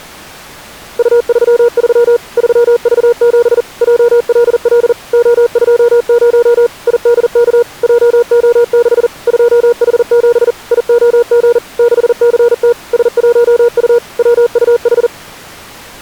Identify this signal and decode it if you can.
Morse code, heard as a keyed tone, machine-sent, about 40 wpm, 480 Hz. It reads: U33 3V7 JLL O20 IDK JO6 2H7 IOG 6CT S1U WUH